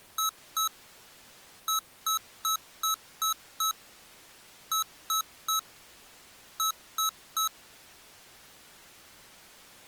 Beep code, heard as beeps from a small speaker, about 1300 Hz. 2-6-3-3.